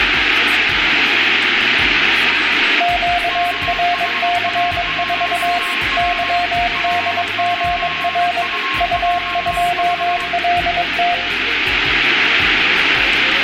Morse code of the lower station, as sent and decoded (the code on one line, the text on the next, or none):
--.- .-. -.-. ....- / -.-- -.. --. .-. / ..- ..--- .-.. -
QRC4 YDGR U2LT